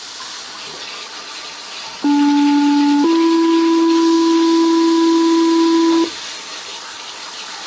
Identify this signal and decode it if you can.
Two-tone page, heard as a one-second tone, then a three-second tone, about 290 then 330 Hz, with the noise of a restroom.